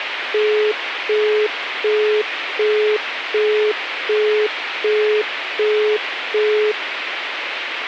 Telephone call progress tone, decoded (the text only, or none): busy tone